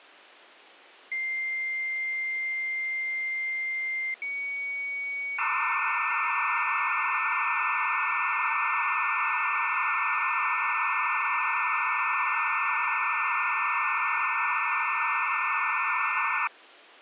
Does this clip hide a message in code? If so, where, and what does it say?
Yes: dial-up modem handshake (low-speed, two carriers) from 1.1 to 16.5 s, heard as two whistles, then hiss.